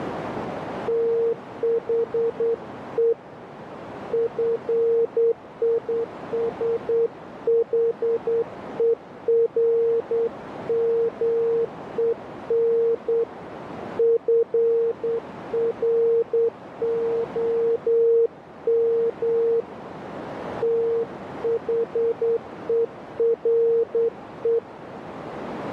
Morse code, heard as a keyed tone, hand-sent with a straight key, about 9 wpm, 460 Hz, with radio static and a narrow filter. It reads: THE FISHERMEN FROM THERE